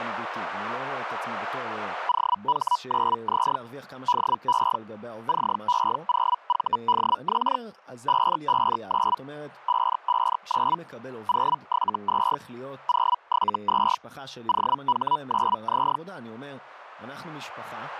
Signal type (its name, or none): Hellschreiber